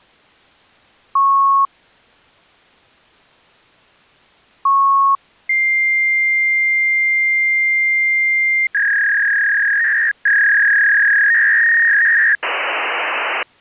Fax machine handshake, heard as beeps, a long tone, a warble and hiss.